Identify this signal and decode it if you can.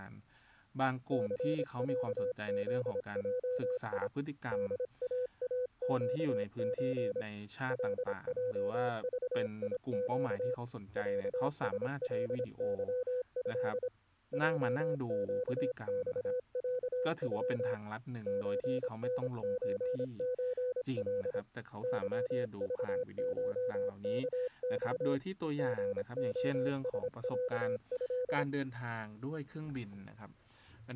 Morse code (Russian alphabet), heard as a keyed tone, hand-sent with a paddle, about 26 wpm, 500 Hz, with speech in Thai. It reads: ЦЯЗЙИ ДААЩЧ ЛЙЖИЩ ЯСЛЫЭ ЙЩЬЯЮ ЧНЧЧЛ ЫЖШКЬ ГОСЯЭ